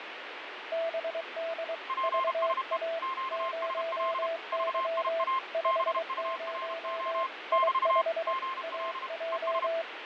Morse code, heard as two keyed tones, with radio static and fading. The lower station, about 23 wpm, 660 Hz: BD VA 0Y 50 I5 AJ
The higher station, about 32 wpm, 1060 Hz: PSE QSL VIA BURO <BT> GL ES